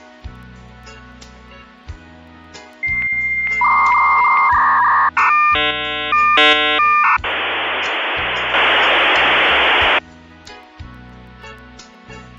Dial-up modem handshake (V.34 or later), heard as a whistle, warbles, then hiss.